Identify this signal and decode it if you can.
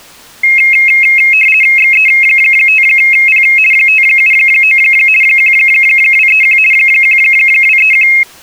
RTTY (50 baud, 450 Hz shift), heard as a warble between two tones, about 2350 Hz centre. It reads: XE5P 579 1231 1231